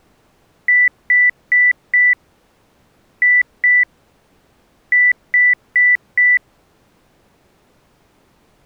Beep code, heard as beeps, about 2000 Hz. 4-2-4. In Phoenix BIOS tables: unexpected interrupt in protected mode.